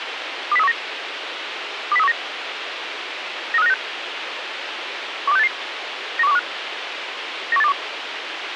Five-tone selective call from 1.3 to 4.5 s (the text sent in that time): 20319 93596